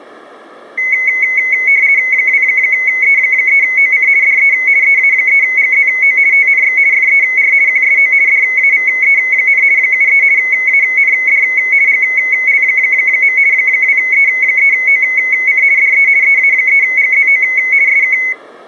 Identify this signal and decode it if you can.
RTTY (50 baud, 170 Hz shift), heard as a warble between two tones, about 2150 Hz centre. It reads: 2E3OC DE EA3GZO TNX FER QSO DAVE, 73 AND GL. 2E3OC DE EA3GZO SK